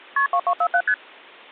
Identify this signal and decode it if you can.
Multi-frequency trunk signalling (R1, as on North American trunks), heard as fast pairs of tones, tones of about 70 ms. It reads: KP 2247 ST